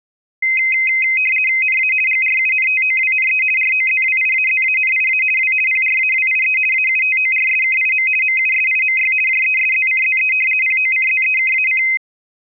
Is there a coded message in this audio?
Yes: RTTY (50 baud, 450 Hz shift) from 0.4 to 12.0 s, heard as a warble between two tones, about 2300 Hz centre. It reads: NA GRUNTOWNE ROZWIAZANIA W PRAWIE AUTORSKIM MUSIMY JESZCZE POCZEKAC